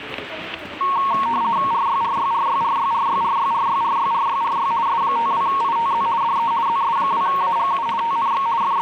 RTTY (50 baud, 170 Hz shift), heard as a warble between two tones, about 1010 Hz centre, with static crashes and the noise of a subway station. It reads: RYRYRYRYRYRYRYRYRYRY S52ITZ DE ZS2AGU TNX …